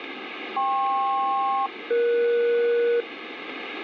Aircraft SELCAL, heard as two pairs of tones, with radio static. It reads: KP-ES